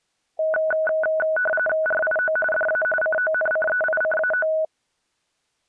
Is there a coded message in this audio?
Yes: RTTY (45.45 baud, 850 Hz shift) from 0.4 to 4.7 s, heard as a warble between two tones, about 1060 Hz centre. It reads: RIO DA CONCEICAO